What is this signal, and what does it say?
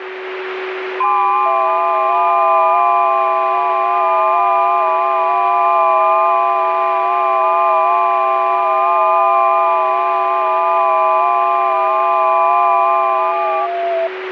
FT8 (several signals at once), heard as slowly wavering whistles, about 6.25 baud, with radio static and a steady whistle near 370 Hz.